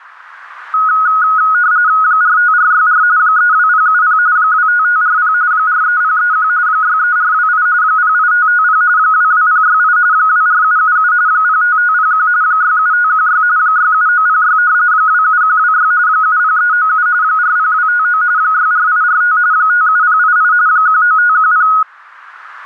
RTTY (45.45 baud, 170 Hz shift), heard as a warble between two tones, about 1360 Hz centre. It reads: 45464 32070 25540 43031 63428 08550 22068 24777 05501 67516 67906 27126 70397 40259 64845 57088 19510